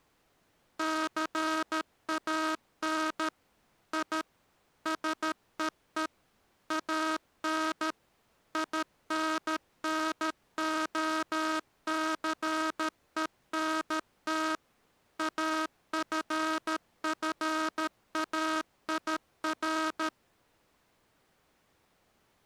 Morse code, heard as a buzzer, machine-sent, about 13 wpm. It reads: CAN I SEE AN INNOCENT AFFAIR